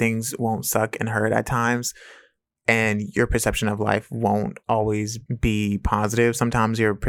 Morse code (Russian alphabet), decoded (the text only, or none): none